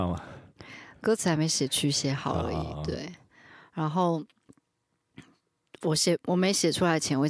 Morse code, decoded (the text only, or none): none